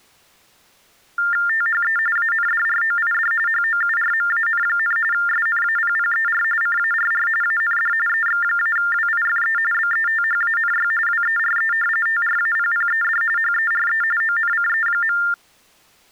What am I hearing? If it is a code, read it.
TTY/TDD text telephone tones (45.45 baud Baudot), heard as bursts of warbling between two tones, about 400 Hz shift, 1600 Hz centre. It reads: THE ANDROID HOURMAN, SNAPPER CARR AND EX-WIFE BETHANY WERE TRAPPED HERE ONCE.